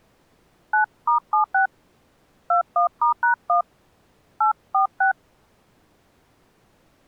DTMF, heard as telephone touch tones, dialled by hand, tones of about 110 ms. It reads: 9*76 21*#1 846